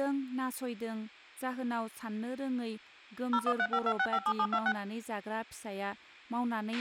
DTMF, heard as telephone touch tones, dialled by machine, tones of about 60 ms, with a squelch burst at the end and speech in Bodo. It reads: 01352657726